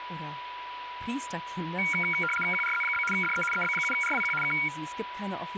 RTTY (75 baud, 850 Hz shift), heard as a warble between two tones, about 1800 Hz centre, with radio static, a steady whistle near 980 Hz and speech in German. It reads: QRZ? DE EB7RWQ K